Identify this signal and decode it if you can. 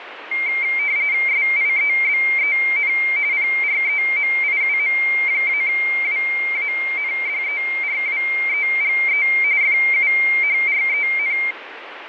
RTTY (45.45 baud, 170 Hz shift), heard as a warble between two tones, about 2200 Hz centre, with radio static. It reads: SIEBEN PREMIUM-WANDERWEGE FUHREN